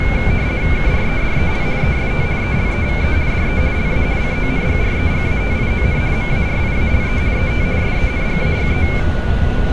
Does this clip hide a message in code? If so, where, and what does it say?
Yes: RTTY (50 baud, 170 Hz shift) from 0.0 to 9.0 s, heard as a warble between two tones, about 2250 Hz centre, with radio static, a steady whistle near 1460 Hz and street noise. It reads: KREDEL EST ELEVE DE LA CONGREGATION MARIALE ET SENGAGE